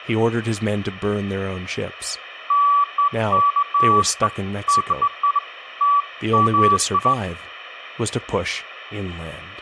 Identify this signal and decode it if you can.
Beeps of irregular length, with room echo and speech in English. There is no code.